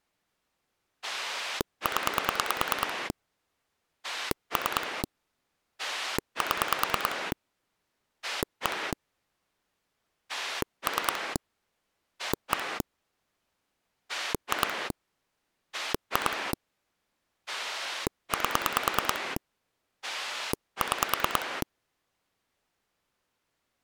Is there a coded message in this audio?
Yes: pulse dialling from 1.0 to 21.6 s, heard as a rotary dial, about 9 pulses a second. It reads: 0 3 7 1 3 1 2 2 8 6